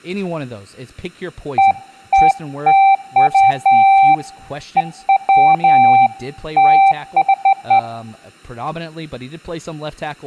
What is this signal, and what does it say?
Beeps of irregular length, with room echo and speech in English. There is no code.